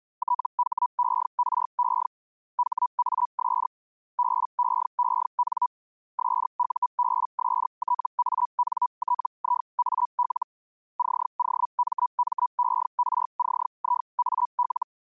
Hellschreiber (Feld-Hell, 122.5 baud), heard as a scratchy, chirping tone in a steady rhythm, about 980 Hz. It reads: THERE HAS BEEN SUBSTANTIAL COMMERCIAL